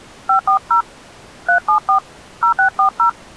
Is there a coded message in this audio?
Yes: DTMF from 0.3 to 3.1 s, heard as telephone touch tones, dialled by hand, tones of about 100 ms. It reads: 540 374 0640